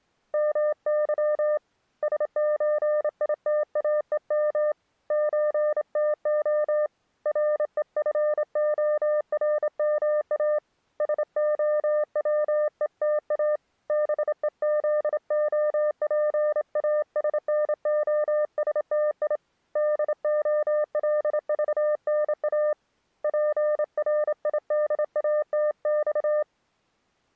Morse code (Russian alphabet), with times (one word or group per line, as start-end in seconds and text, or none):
0.3-1.6 МЫ
2.0-4.7 СЧИТАЕМ
5.1-6.9 ЧТО
7.3-10.6 РЕФОРМА
11.0-13.6 СОВЕТА
13.9-19.4 БЕЗОПАСНОСТИ
19.8-22.7 ДОЛЖНА
23.2-26.4 ПРИДАТЬ